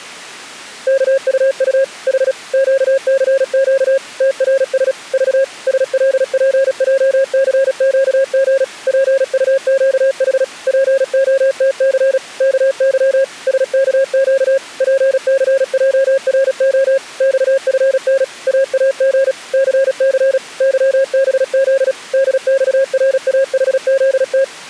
Morse code, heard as a keyed tone, machine-sent, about 36 wpm, 540 Hz. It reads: KUU H QCQ TRS V SLPJCQG PUQH POTC KY SKQ PCJRO XFN AAG CC YBZ DXRAHZT